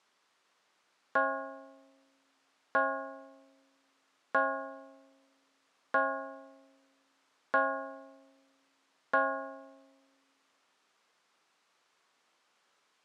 Clock strike, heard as a bell. 6. Six o'clock.